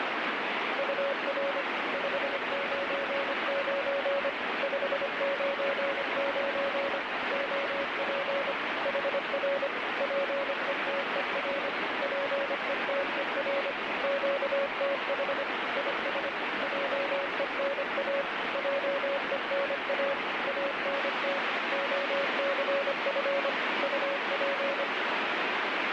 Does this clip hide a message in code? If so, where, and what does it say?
Yes: Morse code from 0.7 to 24.9 s, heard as a keyed tone, machine-sent, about 25 wpm, 560 Hz, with heavy radio static. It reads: UR 599 599 OP HR PETER PETER QTH IS JENA JENA ANT OCF UP